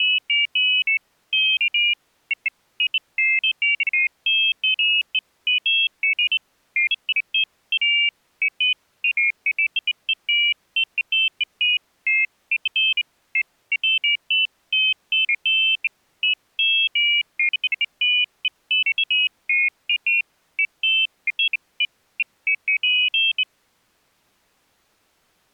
Pairs of high tones at irregular times. There is no code.